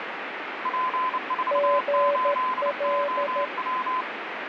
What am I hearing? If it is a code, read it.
Morse code, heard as two keyed tones, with radio static. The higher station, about 29 wpm, 1020 Hz: P48OW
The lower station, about 13 wpm, 570 Hz: GL